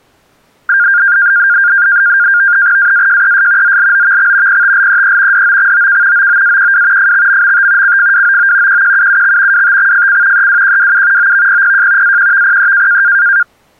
NAVTEX (SITOR-B), 100 baud, 170 Hz shift, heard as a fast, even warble, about 1500 Hz centre. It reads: AAJES ZLOVX PTLEE DOXOK OOAQW FXMMT CFWOO QQUUX WTXFC EWQWU OVPPJ AQVPE